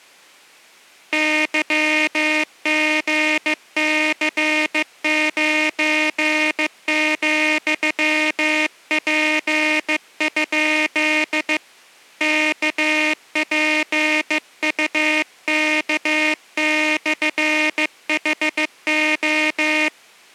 Morse code, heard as a buzzer, hand-sent with a bug key, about 15 wpm. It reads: YGC9,P? KPUK/HO